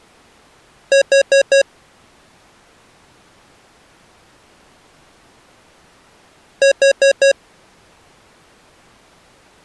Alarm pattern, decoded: temporal four

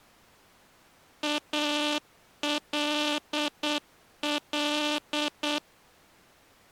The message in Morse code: ALL

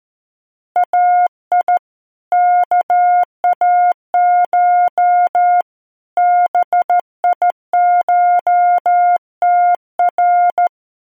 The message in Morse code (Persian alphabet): ای کاش بیشتر

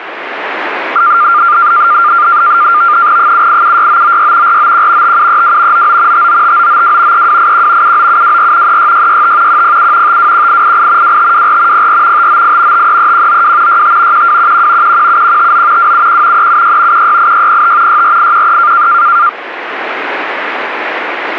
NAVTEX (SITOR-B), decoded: 7876996 491 5732 99 595992 3281 79724 36665 107 521888 2524 04 598 533192 65 1211 117159 271 376 168605 64813

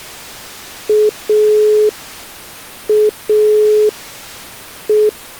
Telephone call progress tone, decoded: dial tone

